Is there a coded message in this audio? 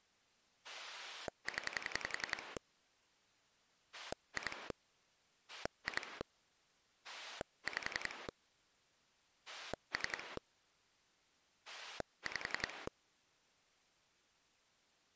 Yes: pulse dialling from 0.6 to 12.9 s, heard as a rotary dial, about 11 pulses a second. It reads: 0 2 2 5 3 5